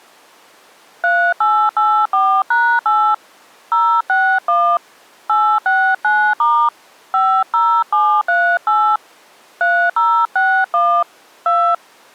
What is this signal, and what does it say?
DTMF, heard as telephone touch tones, dialled by hand, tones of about 290 ms. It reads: 3884#8 061 869* 50738 3061 2